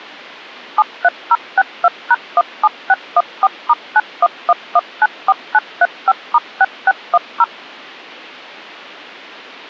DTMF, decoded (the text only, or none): 73062#17614*911194935*6610